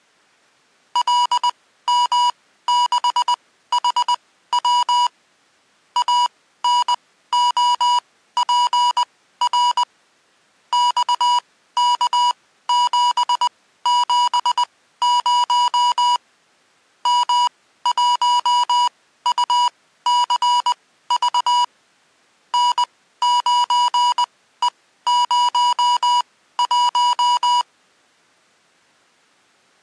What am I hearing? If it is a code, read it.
Morse code, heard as electronic beeps, machine-sent, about 20 wpm, spaced as for 14 wpm, 970 Hz. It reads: LM6HW ANOPR XK770 M1UCV N9E01